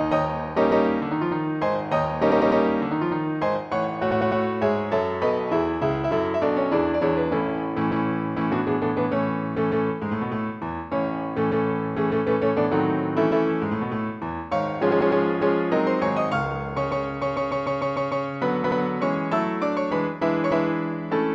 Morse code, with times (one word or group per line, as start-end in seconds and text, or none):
none